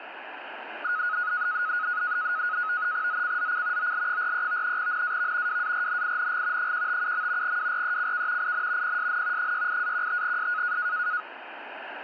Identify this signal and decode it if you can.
NAVTEX (SITOR-B), 100 baud, 170 Hz shift, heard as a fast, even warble, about 1360 Hz centre, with radio static. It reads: ZCZC OL43 NAV WARNING 157. WRECK IN PSN 68-15S